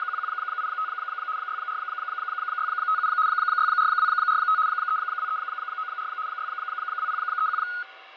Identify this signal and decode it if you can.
RTTY (75 baud, 170 Hz shift), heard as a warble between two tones, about 1360 Hz centre, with radio static, fading, a steady whistle near 770 Hz and room echo. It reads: … 64657 64245 32394 62031